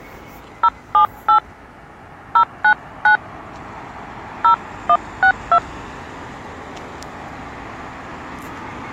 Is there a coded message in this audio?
Yes: DTMF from 0.6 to 5.6 s, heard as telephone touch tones, dialled by hand, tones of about 80 ms, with street noise. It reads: 078 099 0162